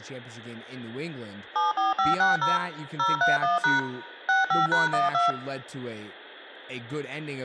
DTMF, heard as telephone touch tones, dialled by machine, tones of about 160 ms, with room echo and speech in English. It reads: 74560 031# 65#12